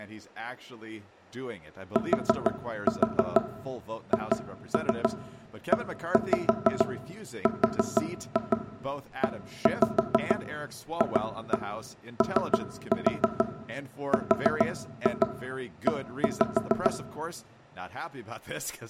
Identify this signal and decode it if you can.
Tap code, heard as knocks on wood, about 6 knocks a second, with room echo and speech in English. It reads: THEREFORE